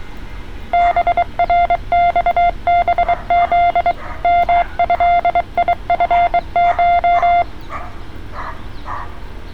Morse code (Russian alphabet), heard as a keyed tone, hand-sent with a bug key, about 23 wpm, 700 Hz, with street noise. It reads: БРЬБЗ МЭИФШ